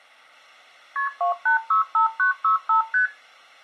Multi-frequency trunk signalling (R1, as on North American trunks), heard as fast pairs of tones, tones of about 120 ms. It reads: KP 2865965 ST